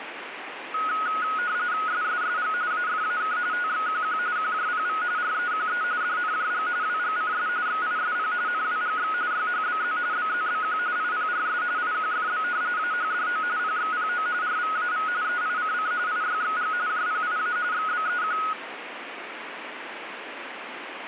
RTTY (45.45 baud, 170 Hz shift), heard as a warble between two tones, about 1360 Hz centre, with radio static. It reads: SSSG AFAK TXQQ QJPV REQE DNJG WGCS XISP NWGX YHBZ BZBQ IPRS IQFB AHDO PXPO RVAV EICC IYXG JPIA XBEQ